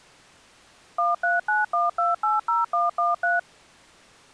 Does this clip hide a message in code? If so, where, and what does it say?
Yes: DTMF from 1.0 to 3.4 s, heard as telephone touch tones, dialled by machine, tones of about 170 ms. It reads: 1391280113